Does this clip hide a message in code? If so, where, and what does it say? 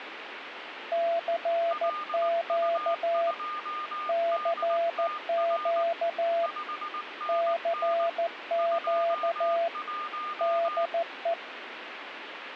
Yes: Morse code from 0.9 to 11.4 s, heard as two keyed tones, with radio static. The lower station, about 14 wpm, 680 Hz: CQ CQ CQ DE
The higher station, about 19 wpm, 1210 Hz: LU2DTR 5NN 21